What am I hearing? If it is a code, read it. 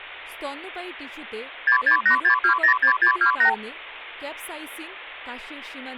Multi-frequency trunk signalling (R2, with the far end's replies), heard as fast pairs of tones, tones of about 100 ms, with speech in Bangla. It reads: 6686206628